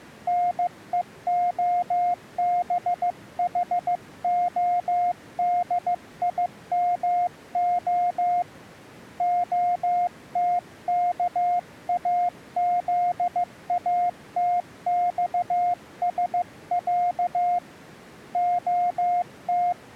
Morse code (Russian alphabet), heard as a keyed tone, hand-sent with a paddle, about 15 wpm, 710 Hz. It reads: НЕОБХОДИМО ОТКАЗАТЬСЯ ОТ